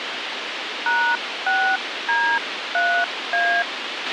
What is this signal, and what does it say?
DTMF, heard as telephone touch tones, dialled by hand, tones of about 290 ms, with radio hiss and a squelch burst at the end. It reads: #6D3A